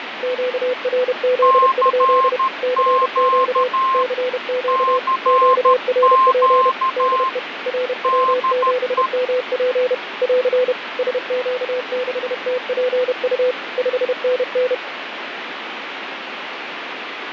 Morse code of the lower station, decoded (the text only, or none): QRZ? CQ CQ QRP DE RW7MP <AR> SQ6TPU 5NN